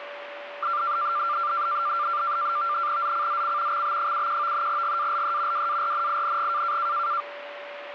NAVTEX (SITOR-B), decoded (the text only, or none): ZCZC XB71 GALE WARNING